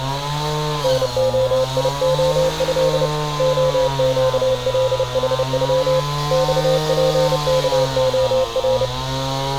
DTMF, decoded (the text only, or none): none